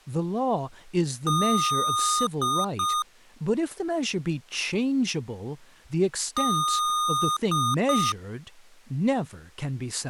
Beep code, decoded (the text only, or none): 1 long, 2 short